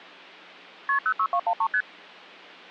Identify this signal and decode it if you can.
Multi-frequency trunk signalling (R1, as on North American trunks), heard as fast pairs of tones, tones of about 70 ms. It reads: KP 06213 ST